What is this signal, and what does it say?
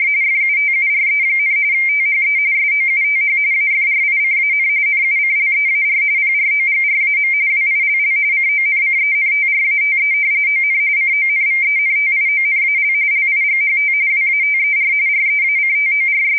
RTTY (45.45 baud, 170 Hz shift), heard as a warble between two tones, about 2200 Hz centre. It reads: … FUTURE, THE SOUTH AFRICAN NUCLEAR PROGRAM WILL CONCENTRATE ON CONVENTIONAL LIGHT WATER …